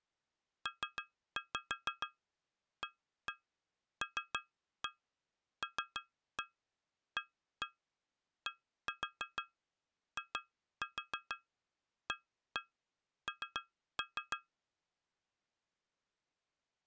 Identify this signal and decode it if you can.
Tap code, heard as taps on glass, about 6 knocks a second. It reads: PALLADIAN